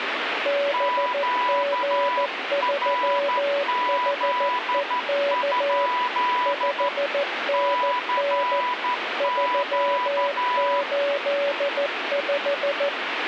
Morse code, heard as two keyed tones, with radio static. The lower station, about 14 wpm, 570 Hz: BG3HEK 5NN 385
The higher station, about 12 wpm, 990 Hz: QRZ? CQ